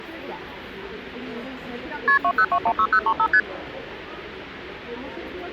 Multi-frequency trunk signalling (R1, as on North American trunks), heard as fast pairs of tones, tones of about 70 ms, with the noise of a crowd indoors. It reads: KP 20216035 ST